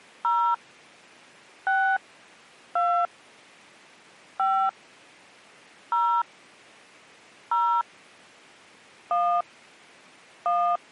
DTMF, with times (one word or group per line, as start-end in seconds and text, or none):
0.2-0.5 0
1.7-2.0 6
2.8-3.1 2
4.4-4.7 5
5.9-6.2 0
7.5-7.8 0
9.1-9.4 1
10.5-10.8 1